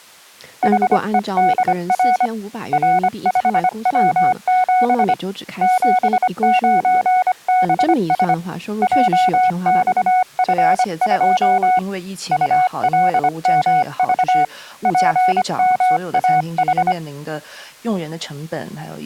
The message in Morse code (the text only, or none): HEDR R5W7 79BS JXF2 ULMV PMAH